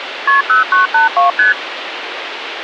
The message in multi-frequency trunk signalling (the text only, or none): KP 0982 ST